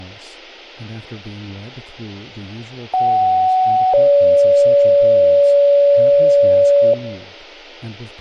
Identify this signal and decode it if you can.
Two-tone page, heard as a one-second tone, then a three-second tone, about 750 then 570 Hz, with speech in English.